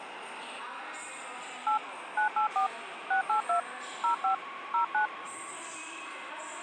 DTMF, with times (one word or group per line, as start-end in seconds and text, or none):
1.7-1.8 8
2.2-2.7 984
3.1-3.6 682
4.0-4.3 05
4.7-5.1 09